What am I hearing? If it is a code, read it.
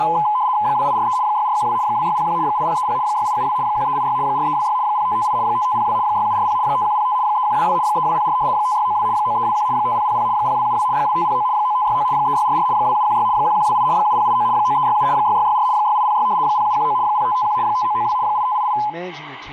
RTTY (75 baud, 170 Hz shift), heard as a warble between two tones, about 930 Hz centre, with speech in English. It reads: 2843 6412 2601 8030 6872 1386 4326 0558 5502 6740 5105 3122 3204 5692 9321 5000 0272 2509 9569 3644 2716 1128 7089 9367 6664 6806 0719 0551 5992 8588